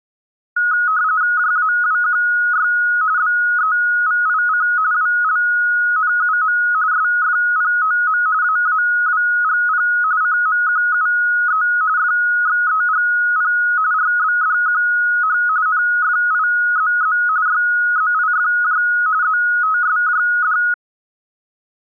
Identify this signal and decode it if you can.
RTTY (45.45 baud, 170 Hz shift), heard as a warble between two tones, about 1360 Hz centre. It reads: JAWQY BEVIC WLNUM SFPOM AAWGP CMQUE FXEGP RBDQH NFIZZ YZIFJ ZTSJD